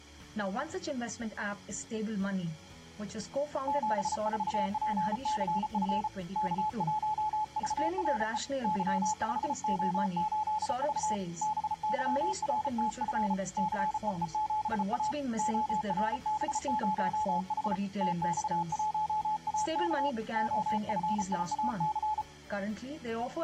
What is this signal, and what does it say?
Morse code, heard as a keyed tone, hand-sent with a paddle, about 34 wpm, 860 Hz. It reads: 74PCF K1VRE Y5O8V BYRTF CEE7A ORB0H TX1AK OFIAC